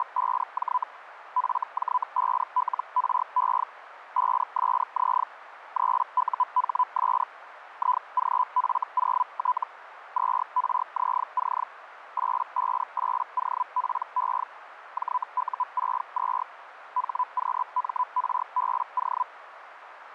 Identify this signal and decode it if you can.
Hellschreiber (Feld-Hell, 122.5 baud), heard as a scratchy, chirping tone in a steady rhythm, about 1000 Hz, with radio static. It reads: … FJ5LRE 5SZ 3UHS IGF0T 2RZC 858OPE JU62 HQMRBO